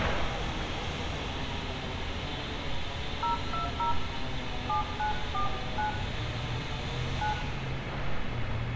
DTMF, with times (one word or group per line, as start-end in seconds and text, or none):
3.2-3.9 020
4.7-5.9 7949
7.2-7.3 9